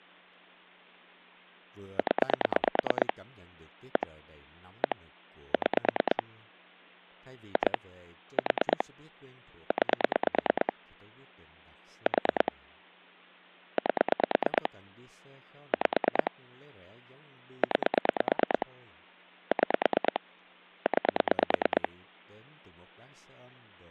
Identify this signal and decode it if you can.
Pulse dialling, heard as clicks on a phone line, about 9 pulses a second, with speech in Vietnamese. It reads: 0 1 1 6 2 4 9 4 8 5 9 6 9